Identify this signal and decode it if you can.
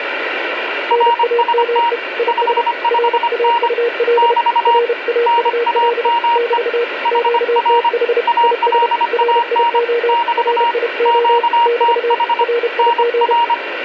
Morse code, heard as two keyed tones, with radio static. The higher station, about 25 wpm, 940 Hz: RST 55N <BT> NAME HR ALAN <BT> QTH NR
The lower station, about 31 wpm, 470 Hz: NAME IS RAUL RAUL <BT> QTH IS RIO RIO <BT> RIG